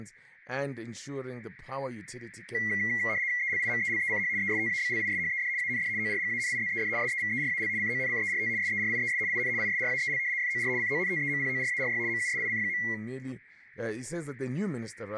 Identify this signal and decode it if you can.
RTTY (75 baud, 170 Hz shift), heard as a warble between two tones, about 2050 Hz centre, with room echo and speech in English. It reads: ELIMELECH ESTABLISHED AND ORGANIZED SEVERAL CONCERT SERIES IN ISRAEL FOR CONTEMPORARY MUSIC.